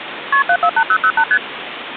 Multi-frequency trunk signalling (R1, as on North American trunks), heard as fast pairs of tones, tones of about 70 ms, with phone line noise. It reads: KP 748008 ST